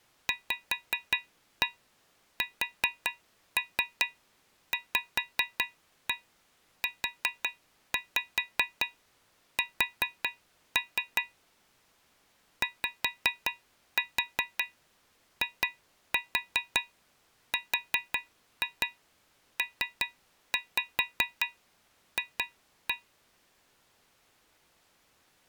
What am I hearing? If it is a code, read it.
Tap code, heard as taps on a metal pipe, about 5 knocks a second. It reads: VSVUS YIRPF